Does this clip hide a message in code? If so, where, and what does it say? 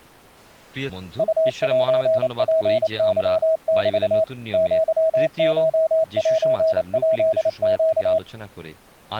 Yes: Morse code (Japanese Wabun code) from 1.1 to 8.2 s, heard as a keyed tone, machine-sent, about 28 wpm, 640 Hz, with speech in Gujarati. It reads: ウセツケメ アコセヱネ